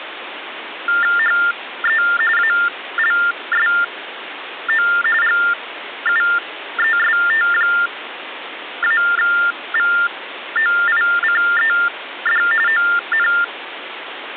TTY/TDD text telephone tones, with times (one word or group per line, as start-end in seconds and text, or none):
1.2-2.0 HE
2.4-4.9 ALSO
5.2-12.4 GUEST-VOICED
12.7-13.3 ON